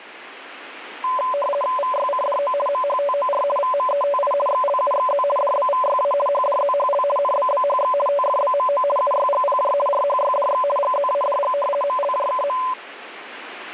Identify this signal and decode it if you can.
RTTY (50 baud, 450 Hz shift), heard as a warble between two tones, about 800 Hz centre, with radio static. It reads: VYCDO MHTOR VMETI XLUXZ DBVYA HDZHL NBBHX TFBMO UYGPJ RHYDX GZADG MLJKM